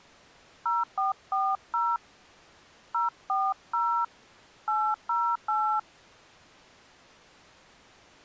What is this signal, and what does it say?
DTMF, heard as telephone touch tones, dialled by hand, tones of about 230 ms. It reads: 0440 040 808